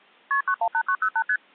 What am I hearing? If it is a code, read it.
Multi-frequency trunk signalling (R1, as on North American trunks), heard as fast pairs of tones, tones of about 70 ms. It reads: KP 918908 ST